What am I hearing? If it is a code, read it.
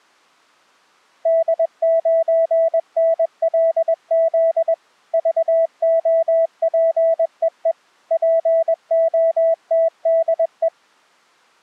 Morse code, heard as a keyed tone, machine-sent, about 21 wpm, 660 Hz. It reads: D9NLZ VOPEE POTDE